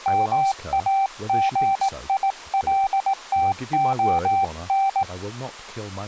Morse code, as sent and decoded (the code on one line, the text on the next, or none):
-- .- --. .. .-.. - --- -.
MAGILTON